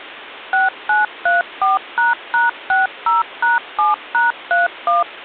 DTMF, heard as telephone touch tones, dialled by machine, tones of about 160 ms. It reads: 6934##60#7#31